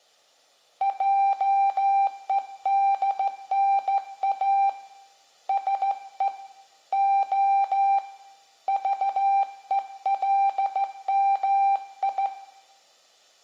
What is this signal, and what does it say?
Morse code, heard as a keyed tone, hand-sent with a straight key, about 15 wpm, 790 Hz, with room echo. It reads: JEDNA SE O VELMI